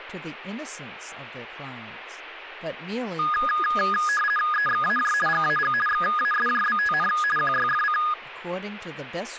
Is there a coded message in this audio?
Yes: RTTY (50 baud, 450 Hz shift) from 3.2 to 8.1 s, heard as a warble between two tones, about 1450 Hz centre, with speech in English. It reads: EXAJ GAG XASJBTN QYFC